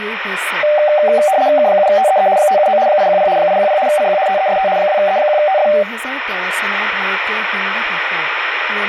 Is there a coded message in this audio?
Yes: RTTY (75 baud, 170 Hz shift) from 0.6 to 5.8 s, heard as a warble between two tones, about 680 Hz centre, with radio static and speech in Assamese. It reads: K7TEE 579 810 810 CQ TEST 2E1TF